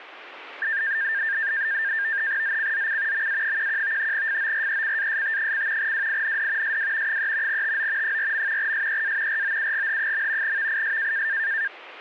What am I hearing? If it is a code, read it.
NAVTEX (SITOR-B), 100 baud, 170 Hz shift, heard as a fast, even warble, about 1700 Hz centre. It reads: ZCZC MA11 FORECAST: WIND SW 3 TO 4. SEA ROUGH. VIS